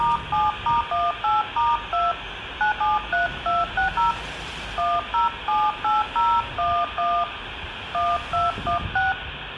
DTMF, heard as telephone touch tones, dialled by hand, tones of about 190 ms, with phone line noise, room echo and street noise. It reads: *7*18*2 973260 1078011 1216